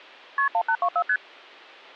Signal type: multi-frequency trunk signalling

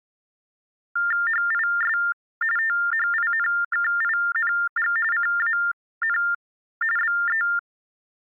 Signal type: TTY/TDD text telephone tones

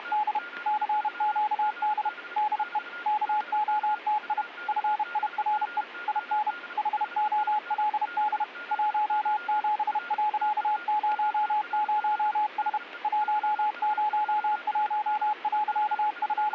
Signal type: Morse code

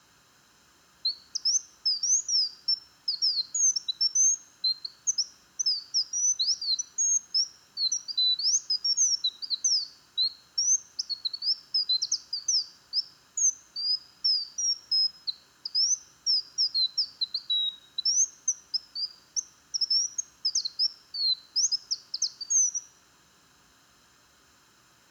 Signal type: none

